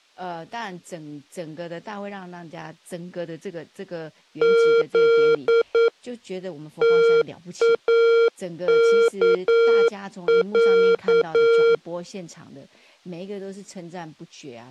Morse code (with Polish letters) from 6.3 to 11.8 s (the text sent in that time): TAKĄ